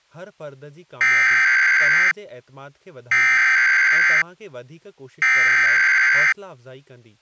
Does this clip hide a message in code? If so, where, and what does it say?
Yes: Emergency Alert System (SAME) tones (header bursts) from 1.0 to 6.3 s, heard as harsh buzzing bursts, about 520.83 baud, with speech in Sindhi.